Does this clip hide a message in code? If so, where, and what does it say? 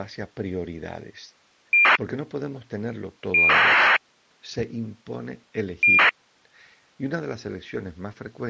Yes: ACARS aircraft data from 1.7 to 6.1 s, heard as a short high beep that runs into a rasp, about 2400 baud.